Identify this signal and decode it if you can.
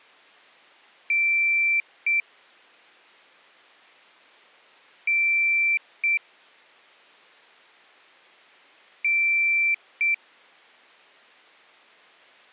Beep code, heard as a piezo beeper, played three times, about 2350 Hz. 1 long, 1 short. In IBM BIOS tables: system board problem.